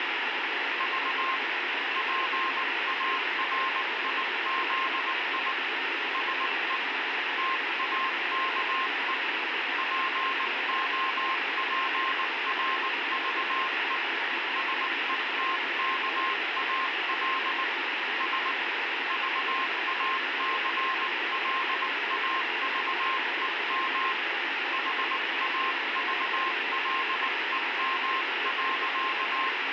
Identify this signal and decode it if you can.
Morse code, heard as a keyed tone, hand-sent with a paddle, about 19 wpm, 1060 Hz, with heavy radio static. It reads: V PARIZI SE TAKE POPRVE SETKAL S VACLAVEM HAVLEM.